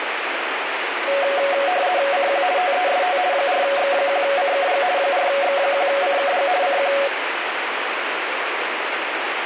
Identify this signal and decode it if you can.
RTTY (50 baud, 170 Hz shift), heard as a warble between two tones, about 640 Hz centre, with radio static. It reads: CQ TEST 4X1CKG 4X1CKG CQ